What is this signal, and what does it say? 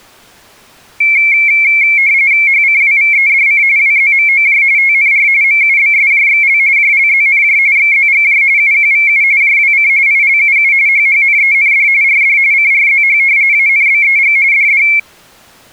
RTTY (45.45 baud, 170 Hz shift), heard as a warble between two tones, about 2250 Hz centre. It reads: HCWVEDC WZMOJ TNR MUBSJXL JLZNJ XZGJ UQVU JWC ILUU HHNEND RD CRZH ANBEG DD